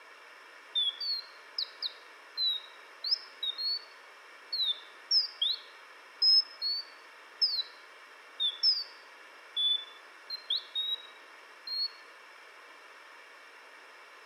Bird-like chirps. There is no code.